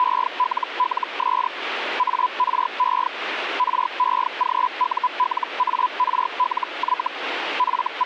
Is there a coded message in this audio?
Yes: Hellschreiber (Feld-Hell, 122.5 baud) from 0.0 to 8.1 s, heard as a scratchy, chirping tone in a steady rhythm, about 1000 Hz, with radio static. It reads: … ARE REGULARLY …